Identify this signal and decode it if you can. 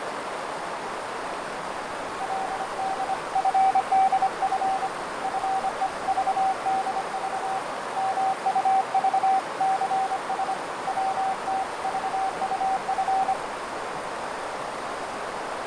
Morse code (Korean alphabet), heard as a keyed tone, hand-sent with a paddle, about 25 wpm, 770 Hz, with heavy radio static, fading and a narrow filter. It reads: 그는 나를 밀쳐 버린